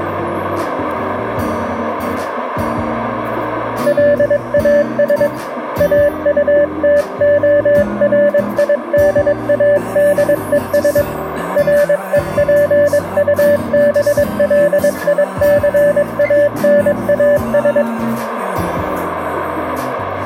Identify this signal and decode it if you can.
Morse code, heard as a keyed tone, hand-sent with a paddle, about 22 wpm, 580 Hz, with radio static. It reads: LAS AUTORIDADES REPUBLICANAS